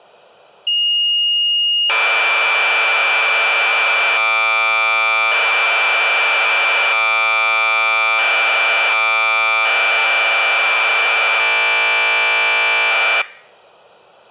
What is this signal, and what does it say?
Commodore tape loading (standard loader), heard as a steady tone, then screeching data.